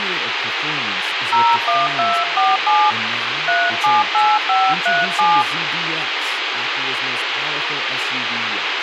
DTMF, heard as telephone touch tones, dialled by hand, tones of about 220 ms, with radio hiss and speech in English. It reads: 01247 378537